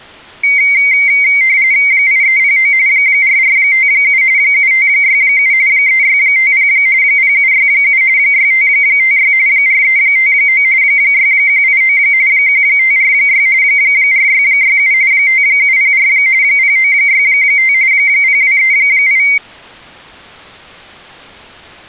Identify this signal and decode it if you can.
RTTY (45.45 baud, 170 Hz shift), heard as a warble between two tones, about 2150 Hz centre. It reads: 8309 4457 7567 3650 0767 6556 4359 6189 1546 4667 5704 0965 0238